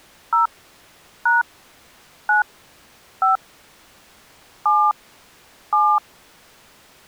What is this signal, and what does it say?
DTMF, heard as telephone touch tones, dialled by hand, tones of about 190 ms. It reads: 0 # 9 5 7 7